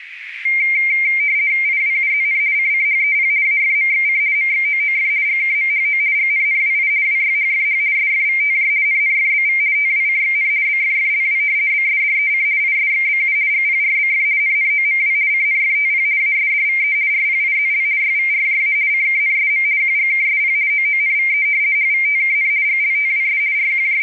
RTTY (50 baud, 170 Hz shift), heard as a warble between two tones, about 2200 Hz centre, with radio static and a narrow filter. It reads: IWUZN CCHEP AFMXC MXOOF GKMHO GNNWI WYHFH SFVTJ NNFBV TWCXN BFFLW BSDEC ISXBU GPRBF NNOMW CNFTP ASDVE RPIZL YVRJA CKNSM QGKSP OONVE HVTKN GLTWS …